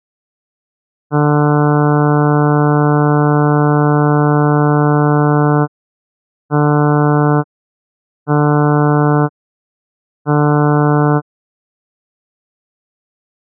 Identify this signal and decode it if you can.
Ship horn signal, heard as a ship's horn, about 150 Hz. 1 long, 3 short. At sea: a vessel under tow in fog.